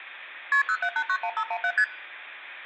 Multi-frequency trunk signalling (R1, as on North American trunks), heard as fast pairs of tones, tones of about 70 ms, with room echo. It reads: KP 07891517 ST